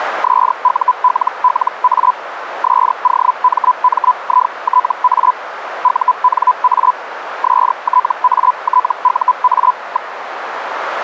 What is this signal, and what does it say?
Hellschreiber (Feld-Hell, 122.5 baud), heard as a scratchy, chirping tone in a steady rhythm, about 1000 Hz, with radio static and a narrow filter. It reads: SULLA SOMMITA UNA STATUA.